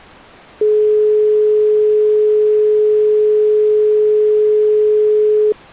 Telephone call progress tone (425 Hz plan, as in most of Europe), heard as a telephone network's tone, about 420 Hz. Dial tone.